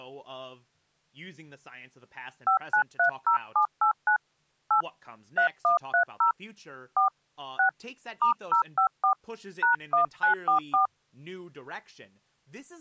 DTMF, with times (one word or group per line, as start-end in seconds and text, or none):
2.5-4.2 5930789
4.7-4.8 8
5.4-6.3 3130
7.0-7.1 4
7.6-7.7 6
8.2-9.1 *054
9.6-10.9 #1944